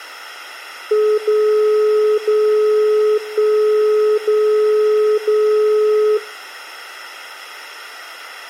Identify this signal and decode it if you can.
Radio time signal (DCF77), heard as a tone whose level steps once a second, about 430 Hz, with room echo. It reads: 0 0 1 0 0